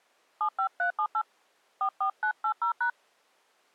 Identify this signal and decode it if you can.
DTMF, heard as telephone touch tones, dialled by hand, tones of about 90 ms. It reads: 75378 44980#